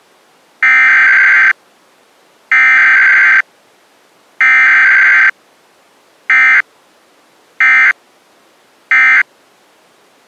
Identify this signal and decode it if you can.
Emergency Alert System (SAME) tones (header bursts, then end-of-message bursts), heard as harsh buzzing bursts, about 520.83 baud.